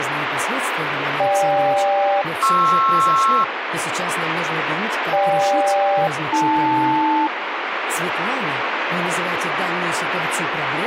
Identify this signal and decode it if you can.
Aircraft SELCAL, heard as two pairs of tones, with radio static. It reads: GK-PR GK-AL